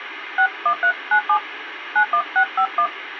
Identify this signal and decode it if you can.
DTMF, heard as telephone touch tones, dialled by hand, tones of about 80 ms, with phone line noise. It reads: 61397 91651